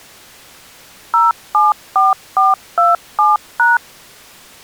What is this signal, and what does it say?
DTMF, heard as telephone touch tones, dialled by machine, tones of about 170 ms. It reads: 074427#